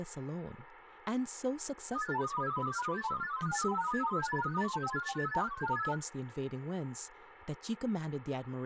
Multi-tone FSK (Olivia or MFSK type), about 1000 Hz wide, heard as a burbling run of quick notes, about 31.25 baud, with radio static and speech in English.